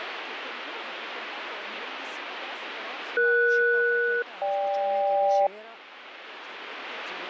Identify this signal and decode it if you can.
Aircraft SELCAL, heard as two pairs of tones, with radio static. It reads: ES-GK